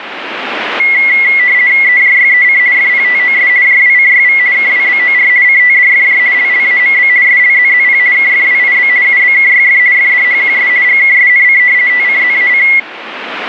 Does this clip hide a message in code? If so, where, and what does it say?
Yes: RTTY (50 baud, 170 Hz shift) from 0.8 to 12.8 s, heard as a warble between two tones, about 2050 Hz centre, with radio static. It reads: EJYEC FPTOS JWCYV KWBOR CTDFJ LLAMB SLZZP KFWIB UBKYF FDHQS GKSNC TCZAC